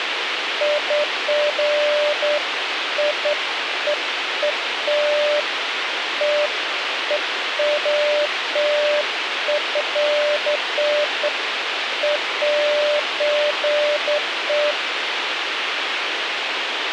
Beeps of irregular length, with radio hiss and a squelch burst at the end. There is no code.